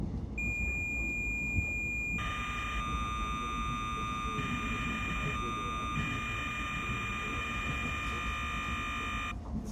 Cassette data (Kansas City type), 1200 baud, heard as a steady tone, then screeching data, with the noise inside a subway train.